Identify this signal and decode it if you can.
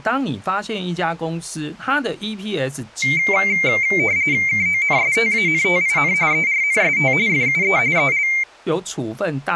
RTTY (45.45 baud, 170 Hz shift), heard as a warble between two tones, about 2200 Hz centre, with speech in Chinese. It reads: KONSTANTIN ERNST FUE EL